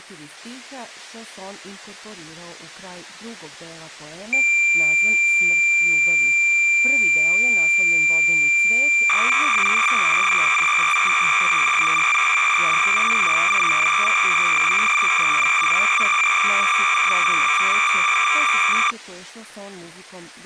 Cassette data (Kansas City type), 300 baud, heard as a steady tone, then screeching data.